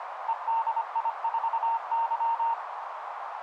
Morse code, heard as a keyed tone, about 25 wpm, 920 Hz, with radio static and a narrow filter. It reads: EDI4Y